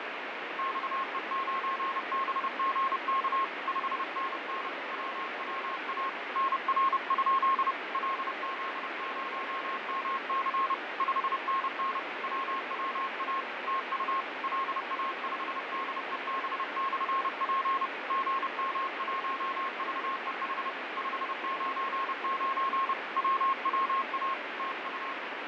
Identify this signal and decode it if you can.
Morse code, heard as a keyed tone, hand-sent with a paddle, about 30 wpm, 1080 Hz, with heavy radio static and fading. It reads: XE9BGK 5NN WWA NR? LZ0MC 5NN WWA TU LA5DEB/P GM1VEH 599 WWA TU